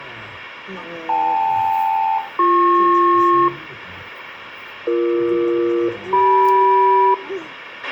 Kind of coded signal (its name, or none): aircraft SELCAL